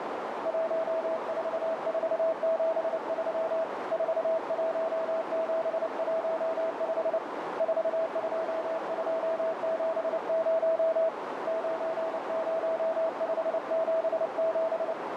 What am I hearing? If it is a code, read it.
Morse code, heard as a keyed tone, hand-sent with a paddle, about 29 wpm, 650 Hz, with heavy radio static and a narrow filter. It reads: 14473 41715 42270 90577